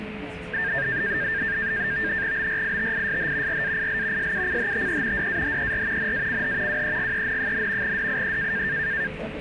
NAVTEX (SITOR-B), 100 baud, 170 Hz shift, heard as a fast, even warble, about 1700 Hz centre, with radio static, a steady whistle near 430 Hz and the noise inside a subway train. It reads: BRITISH RAIL SUCHTE DAHER NACH WEGEN, DIE